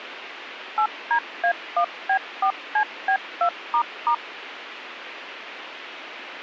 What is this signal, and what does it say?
DTMF, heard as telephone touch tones, dialled by machine, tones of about 80 ms, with radio hiss and a squelch burst at the end. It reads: 8DA1B4CB2**